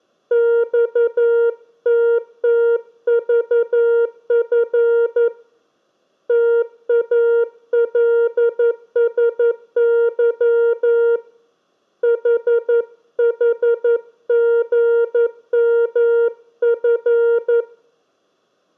Morse code, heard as a keyed tone, hand-sent with a paddle, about 11 wpm, 470 Hz, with room echo. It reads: XTTVF TALSY HHGMF